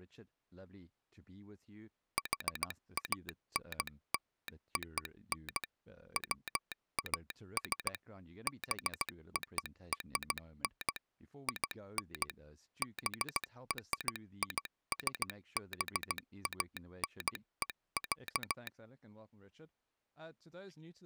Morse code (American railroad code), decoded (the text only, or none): HANLON WAS BORN IN BRISBANE,